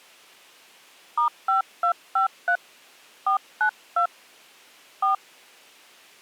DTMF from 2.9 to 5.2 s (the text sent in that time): 492 4